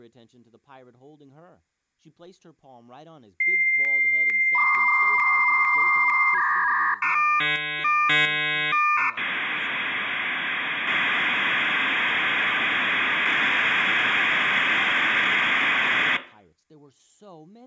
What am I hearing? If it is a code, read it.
Dial-up modem handshake (V.34 or later), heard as a whistle, warbles, then hiss, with speech in English.